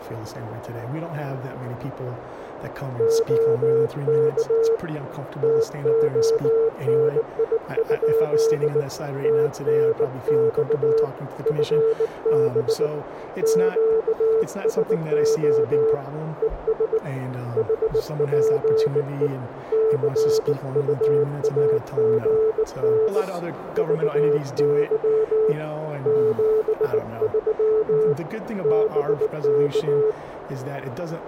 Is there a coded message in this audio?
Yes: Morse code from 2.9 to 30.2 s, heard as a keyed tone, hand-sent with a bug key, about 19 wpm, 440 Hz, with radio static and a narrow filter. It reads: OK TONI? TNX FB QSO ES HPE CUAGN VY 73 BK